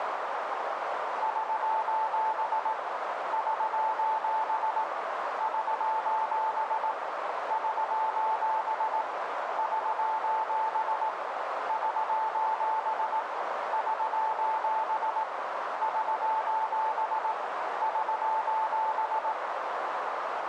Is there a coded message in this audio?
Yes: Morse code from 1.2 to 19.4 s, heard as a keyed tone, hand-sent with a paddle, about 18 wpm, 880 Hz, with heavy radio static and a narrow filter. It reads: <SOS> <SOS> <SOS> <SOS> <SOS> <SOS> <SOS> <SOS> <SOS>